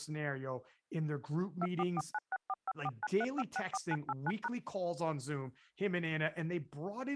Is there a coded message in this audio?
Yes: DTMF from 1.6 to 4.5 s, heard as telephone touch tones, dialled by machine, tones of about 40 ms, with speech in English. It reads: 2449645493564989#